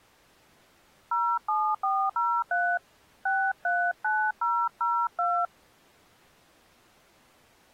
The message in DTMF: 07403 639002

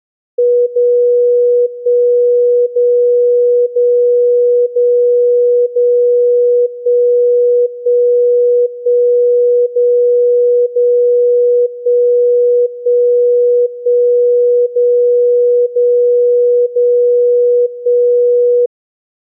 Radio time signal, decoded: 0 1 0 0 0 0 1 1 1 0 0 1 1 1 0 0 0 1

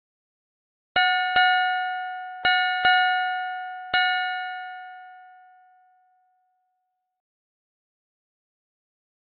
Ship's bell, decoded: 5

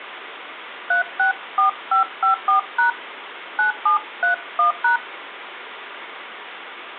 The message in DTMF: 364554# 9731#

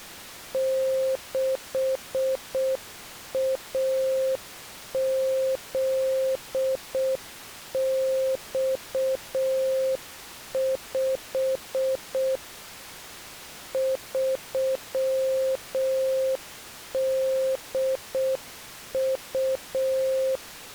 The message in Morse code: 6AZX5 3DU

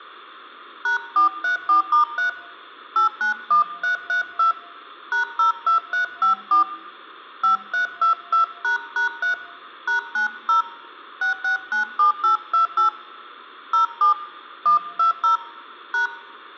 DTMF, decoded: #434*3 891332 #02354 5322##3 #90 6697828 07 120 #

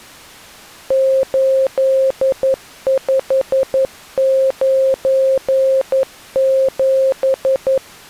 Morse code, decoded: 8597

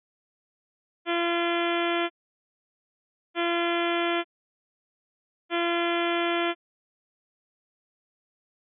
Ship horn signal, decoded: 3 short

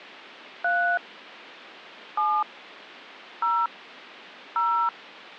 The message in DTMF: 3 7 0 0

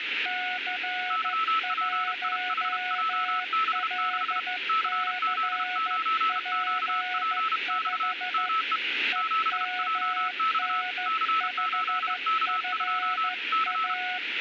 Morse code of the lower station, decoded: C1LCP5 EMN5FA

